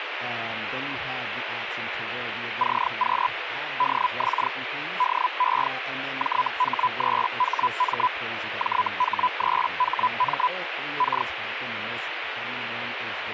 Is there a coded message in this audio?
Yes: Hellschreiber (Feld-Hell, 122.5 baud) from 2.6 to 11.3 s, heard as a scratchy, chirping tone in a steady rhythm, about 1000 Hz, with radio static and speech in English. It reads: CQ DX DE JH3HM JH3HM K